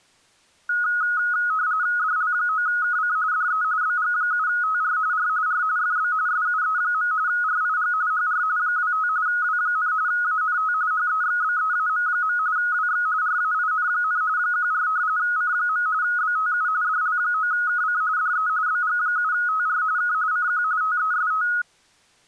RTTY (45.45 baud, 170 Hz shift), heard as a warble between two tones, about 1360 Hz centre. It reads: DL9KC DE BG7TR R R FB SUE. RIG HR 25 W, ANT HEXBEAM. WX RAIN, 14 C. BTU DL9KC DE BG7TR K CQ TEST